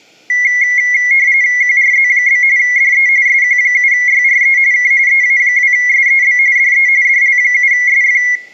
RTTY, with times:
1.6-2.4 QRZ?
2.6-3.1 DE
3.3-4.6 SQ7YRE
4.7-4.9 K
5.1-6.4 EA2SEB
6.6-6.9 DE
7.0-8.2 DL7SF

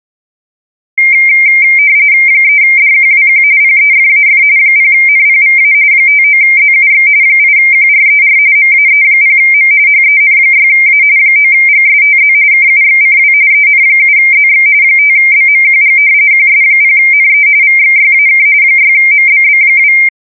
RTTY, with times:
2.3-3.4 3DQWQ
3.6-4.4 PEFAF
4.6-5.7 0NPVA
5.9-7.1 59ZUX
7.2-8.4 8QRER
8.6-9.7 MAE0M
9.9-11.0 HEN6A
11.2-12.3 9GSTZ
12.5-13.3 KUXCW
13.5-14.7 EN7ZX
14.8-16.0 5BMQG
16.3-17.5 QS0NE
17.6-18.5 VXYAK
18.6-19.9 6MBB2

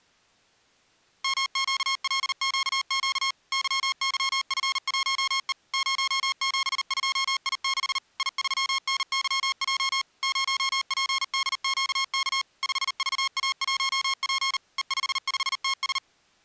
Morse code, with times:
1.2-3.3 MQLQQ
3.5-5.5 YYF1E
5.7-8.0 072I6
8.2-10.0 I3NYJ
10.2-12.4 0PDQK
12.6-14.6 5VA1P
14.8-16.0 E55TS

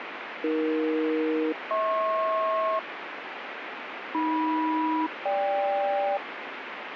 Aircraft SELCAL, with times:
0.4-2.8 AE-HP
4.1-6.2 AM-GK

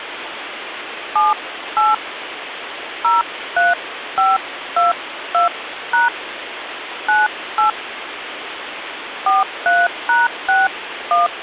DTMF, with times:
1.2-1.9 78
3.0-6.1 03522#
7.1-7.7 98
9.3-11.3 43#61

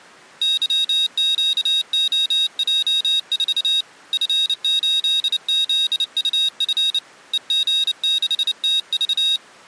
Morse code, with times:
0.4-3.8 YQOJ4
4.1-7.0 F8ZUF
7.3-9.4 EG6TV

